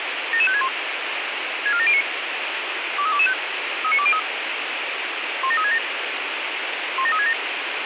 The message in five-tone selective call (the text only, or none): 77561 64709 23225 39203 17367 17367